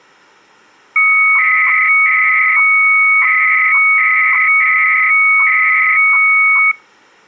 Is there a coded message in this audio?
Yes: 300-baud modem data (Bell 103 tones) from 1.0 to 6.7 s, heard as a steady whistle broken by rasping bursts, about 300 baud, 200 Hz shift.